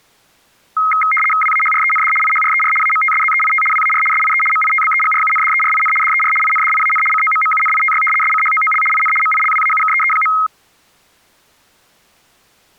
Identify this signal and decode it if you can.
RTTY (75 baud, 850 Hz shift), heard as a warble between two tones, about 1700 Hz centre. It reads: WAHREND IHRER AMTSZEIT WAR SIE MITBEGRUNDERIN DER INDIAN COMMUNITY SCHOOL IN MILWAUKEE.